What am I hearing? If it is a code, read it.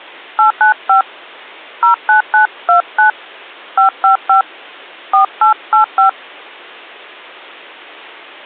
DTMF, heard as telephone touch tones, dialled by hand, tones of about 120 ms. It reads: 895 09929 555 4885